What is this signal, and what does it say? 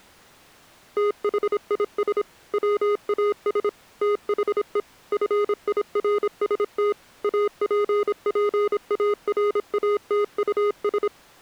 Morse code, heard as electronic beeps, machine-sent, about 26 wpm, 410 Hz. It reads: THIS WAS THE FIRST APPARATUS